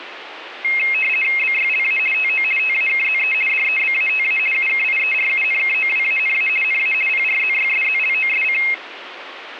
RTTY (50 baud, 450 Hz shift), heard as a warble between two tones, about 2350 Hz centre, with radio static. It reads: BYLA TO TAKZE DEBATA UKIERUNKOWANA NA PRZYSZLOSC